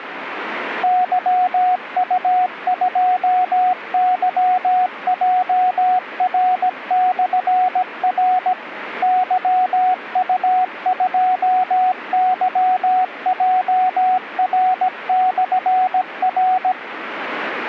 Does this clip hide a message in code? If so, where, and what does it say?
Yes: Morse code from 0.8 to 16.8 s, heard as a keyed tone, machine-sent, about 17 wpm, 740 Hz, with radio static. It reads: YU2YJR/R YU2YJR/R